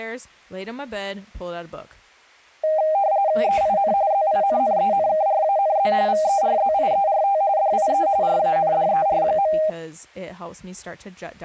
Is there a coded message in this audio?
Yes: RTTY (45.45 baud, 170 Hz shift) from 2.6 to 9.7 s, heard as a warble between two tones, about 710 Hz centre, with speech in English. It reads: EIN ZINNENKRANZ VERZIERT DIE RANDER.